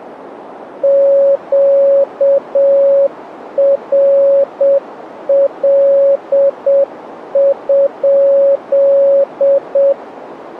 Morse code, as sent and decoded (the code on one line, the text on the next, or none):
--.- .-. .-.. ..--..
QRL?